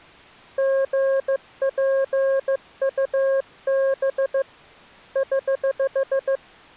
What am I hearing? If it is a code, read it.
Morse code, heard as a keyed tone, hand-sent with a paddle, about 15 wpm, 540 Hz. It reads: GPUB <HH>